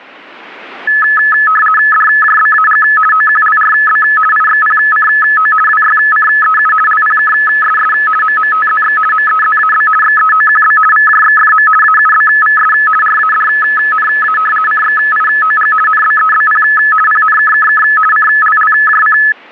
RTTY (50 baud, 450 Hz shift), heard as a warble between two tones, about 1500 Hz centre. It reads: DJBAG OQLRB IXPCO WYCEU LPKSS MMTZX MEZAB XEOQB VJXFM AUBVS RADNA CXIOG NBEBP PNKKK CLLJC